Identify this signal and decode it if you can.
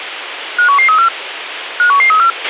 Five-tone selective call (CCIR), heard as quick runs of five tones, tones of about 100 ms, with radio hiss and a squelch burst at the end. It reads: 51134 51134